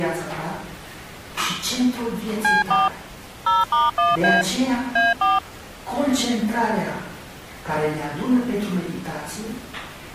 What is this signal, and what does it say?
DTMF, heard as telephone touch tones, dialled by machine, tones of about 180 ms. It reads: C4 0*1A A4